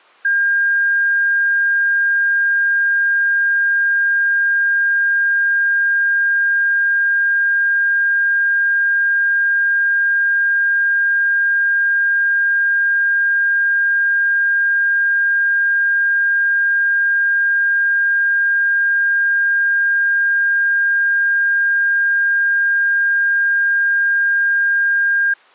A steady tone. There is no code.